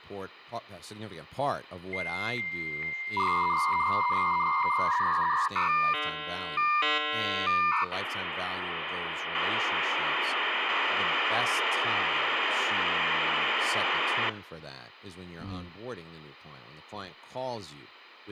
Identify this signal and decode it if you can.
Dial-up modem handshake (V.34 or later), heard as a whistle, warbles, then hiss, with phone line noise and speech in English.